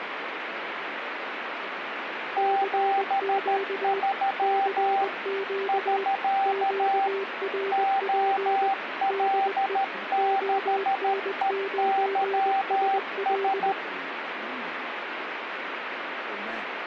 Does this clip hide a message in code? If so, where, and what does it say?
Yes: Morse code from 2.3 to 13.8 s, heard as two keyed tones, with radio static. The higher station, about 13 wpm, 780 Hz: 73 <SK> OL6EYS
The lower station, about 20 wpm, 390 Hz: CQ CQ QRP DE ON9SL